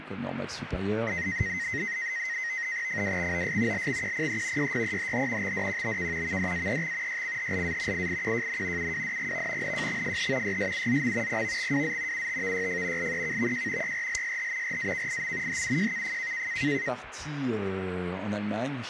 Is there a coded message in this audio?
Yes: NAVTEX (SITOR-B), 100 baud, 170 Hz shift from 1.1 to 16.9 s, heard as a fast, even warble, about 1950 Hz centre, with radio static. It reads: FWXOS LXQPE YYEHH XDQBK VDAEX YCHLA IIQJN UWDGV NJXFH YSUZM PVXWZ UTVYF LEKVJ YRLSH RAKIM HUJKF